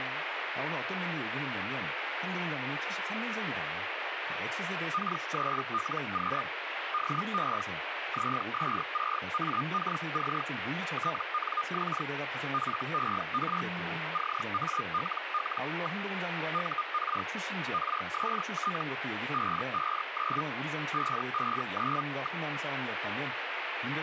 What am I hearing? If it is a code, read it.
Hellschreiber (Feld-Hell, 122.5 baud), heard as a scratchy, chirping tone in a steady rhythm, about 1220 Hz, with radio static and speech in Korean. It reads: K3LQ DE ZS6AKC TNX FER CALL. UR RST 559 559.